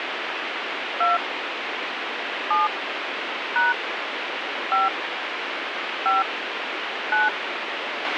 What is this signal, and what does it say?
DTMF, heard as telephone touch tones, dialled by hand, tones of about 170 ms, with radio hiss and a squelch burst at the end. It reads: 2 7 # 5 5 9